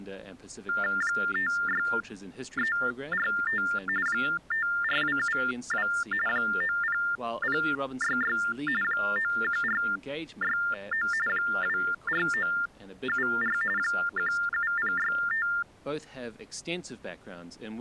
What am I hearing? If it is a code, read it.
TTY/TDD text telephone tones (45.45 baud Baudot), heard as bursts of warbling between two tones, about 400 Hz shift, 1600 Hz centre, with speech in English. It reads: 56345 54272 90066 91469 24974 17065